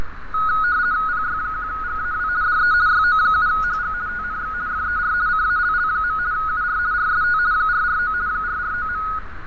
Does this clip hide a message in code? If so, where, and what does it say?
Yes: RTTY (50 baud, 170 Hz shift) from 0.3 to 9.2 s, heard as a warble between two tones, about 1360 Hz centre, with radio static, fading, a narrow filter and street noise. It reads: PY1GAW DE YO7HG TNX FER CALL. UR RST 449 449.